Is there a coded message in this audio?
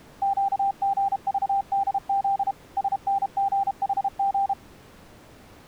Yes: Morse code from 0.2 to 4.6 s, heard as a keyed tone, machine-sent, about 32 wpm, 790 Hz. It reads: QGVDZ SNGHG